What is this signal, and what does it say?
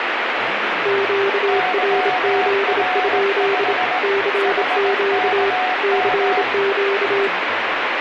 Morse code, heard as two keyed tones, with radio static and speech in Tamil. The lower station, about 27 wpm, 400 Hz: QRZ? CQ CQ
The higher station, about 18 wpm, 740 Hz: YR5 HKM